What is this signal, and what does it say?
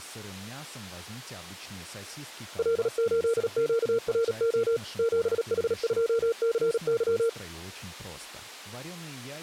Morse code, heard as a keyed tone, machine-sent, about 37 wpm, 460 Hz, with speech in Russian. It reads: L8QRO 7H2CY